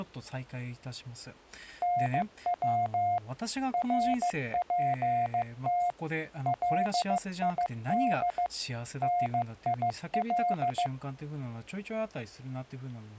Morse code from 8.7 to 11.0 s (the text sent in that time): NIL